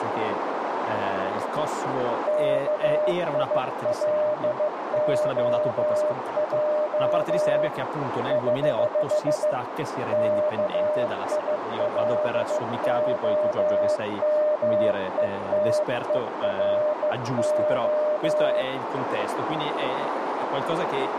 Morse code, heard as a keyed tone, hand-sent with a bug key, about 15 wpm, 600 Hz, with radio static, a narrow filter and speech in Italian. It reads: KILOJ <HH> KILOMETERO